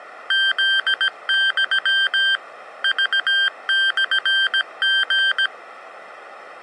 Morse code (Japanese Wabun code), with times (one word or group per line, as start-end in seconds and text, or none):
0.3-2.3 フユ
2.8-5.5 クモリ